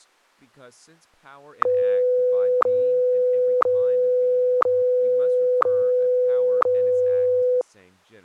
Radio time signal (WWVH, Hawaii), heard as ticks, one a second, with speech in English.